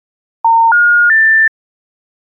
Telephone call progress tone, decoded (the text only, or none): special information tone